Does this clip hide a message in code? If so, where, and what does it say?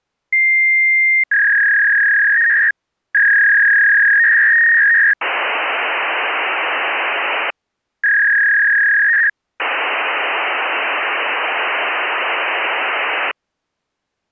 Yes: fax machine handshake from 0.3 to 13.3 s, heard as a long tone, a warble and hiss.